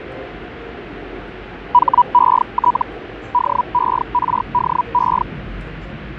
Hellschreiber (Feld-Hell, 122.5 baud), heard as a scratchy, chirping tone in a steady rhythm, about 980 Hz, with the noise inside a subway train. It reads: HET DERDE